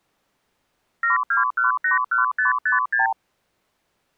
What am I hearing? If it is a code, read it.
Multi-frequency trunk signalling (R2, with the far end's replies), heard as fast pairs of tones, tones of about 140 ms. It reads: 72181556